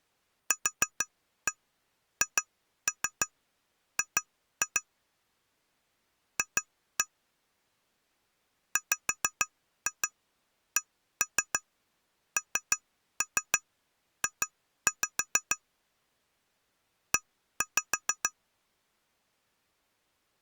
Tap code, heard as taps on glass, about 6 knocks a second. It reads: QHG F WCNJ E